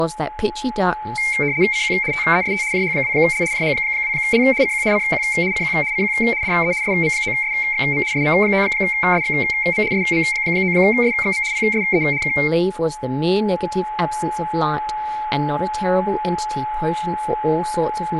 RTTY (75 baud, 170 Hz shift), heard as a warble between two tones, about 2200 Hz centre, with a steady whistle near 850 Hz, room echo and speech in English. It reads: CQ TEST JH2L JH2L CQ CQ CQ CQ DE SM9SXM SM9SXM SM9SXM PSE K